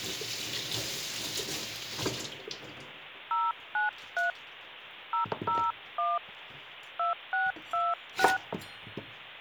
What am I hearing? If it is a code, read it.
DTMF, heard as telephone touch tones, dialled by hand, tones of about 170 ms, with kitchen noise. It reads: 093 001 2626